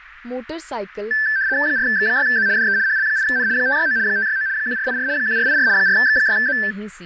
RTTY (75 baud, 170 Hz shift), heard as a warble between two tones, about 1650 Hz centre, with radio static, fading and speech in Punjabi. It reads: 4X6Z DE HL8N 569 569 1484 1484 4X6Z